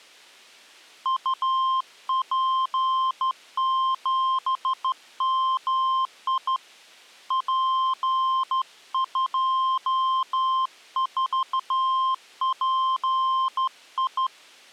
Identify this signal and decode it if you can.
Morse code, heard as a keyed tone, hand-sent with a straight key, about 13 wpm, 1050 Hz. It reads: UP7MI P24PI